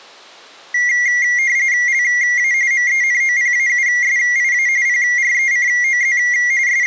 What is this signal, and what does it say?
RTTY (45.45 baud, 170 Hz shift), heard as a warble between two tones, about 2050 Hz centre. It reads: LA MENOPAUSIA PRECOZ …